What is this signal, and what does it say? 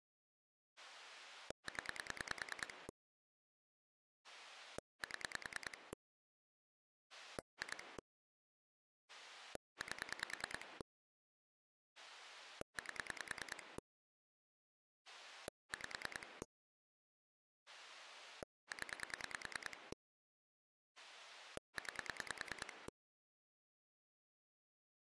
Pulse dialling, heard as a rotary dial, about 10 pulses a second. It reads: 0 7 2 8 8 5 0 9